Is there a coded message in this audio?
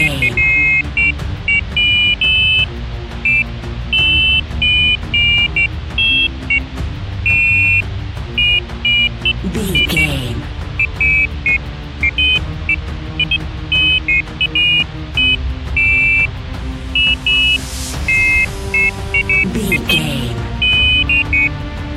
No, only pairs of high tones at irregular times.